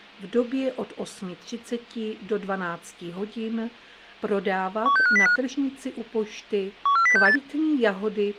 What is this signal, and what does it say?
Five-tone selective call (CCIR), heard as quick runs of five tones, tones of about 100 ms. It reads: 16505 14068